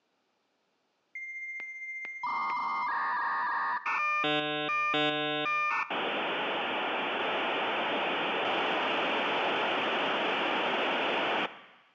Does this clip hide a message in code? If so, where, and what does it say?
Yes: dial-up modem handshake (V.34 or later) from 1.2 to 11.5 s, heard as a whistle, warbles, then hiss.